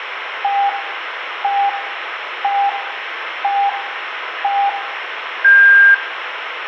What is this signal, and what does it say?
Radio time signal (five pips and a higher one, as on Chinese radio), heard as pips, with radio static and room echo.